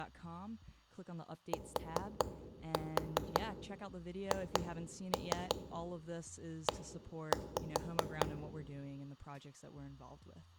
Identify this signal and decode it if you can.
Tap code, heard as knocks on wood, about 5 knocks a second, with speech in English. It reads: THE